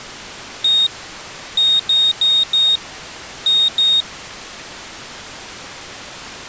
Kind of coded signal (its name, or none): beep code